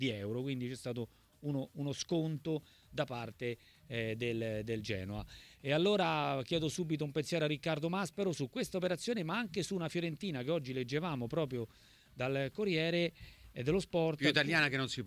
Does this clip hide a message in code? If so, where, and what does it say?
No.